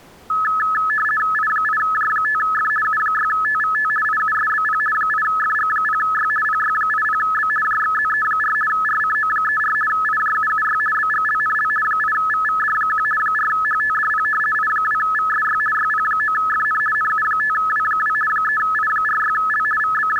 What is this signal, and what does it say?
RTTY (50 baud, 450 Hz shift), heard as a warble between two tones, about 1500 Hz centre. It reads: I8J5F U6TVT IUSBP 8FG0Y PY80B JXZE4 RCO34 IJUUY BGLNL 8VVD1 4HTDP I2VSY YP9FN NU5W2 3I46L …